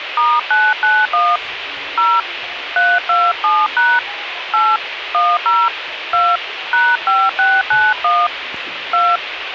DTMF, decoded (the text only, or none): *991 0 327# 8 10 2 #5691 2